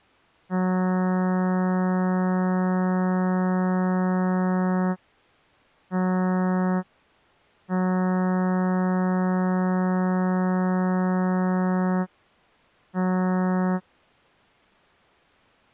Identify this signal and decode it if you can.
Ship horn signal, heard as a ship's horn, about 180 Hz. 1 long, 1 short, 1 long, 1 short. At sea: I agree to be overtaken.